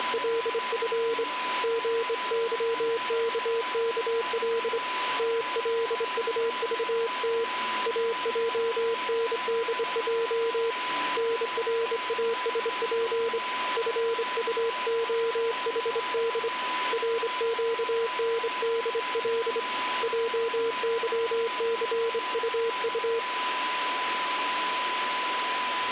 Morse code, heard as a keyed tone, hand-sent with a straight key, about 25 wpm, 460 Hz, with radio static and a steady whistle near 1000 Hz. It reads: … GYKKL TLUVT AJNDJ NRASP FUOHD RQNDL JYCUU